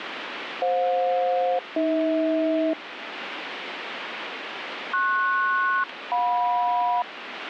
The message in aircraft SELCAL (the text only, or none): FJ-AH PS-JM